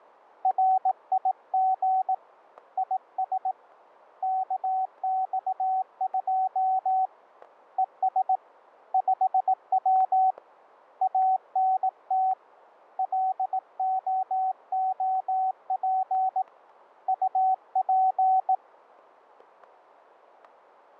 Morse code, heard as a keyed tone, hand-sent with a bug key, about 18 wpm, 760 Hz, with static crashes. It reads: RIG IS KX2 ES 5W ANT LOOP UP